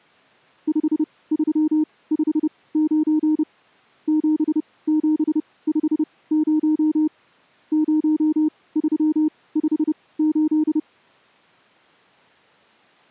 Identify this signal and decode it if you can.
Morse code, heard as a keyed tone, machine-sent, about 30 wpm, spaced as for 20 wpm, 310 Hz. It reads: 5359 7750 0358